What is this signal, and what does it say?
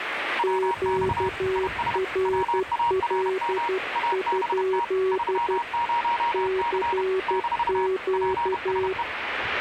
Morse code, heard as two keyed tones, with radio static and the noise of a park. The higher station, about 31 wpm, 940 Hz: WX IS WARM ABT 30C - PSE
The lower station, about 12 wpm, 380 Hz: QRL? CQ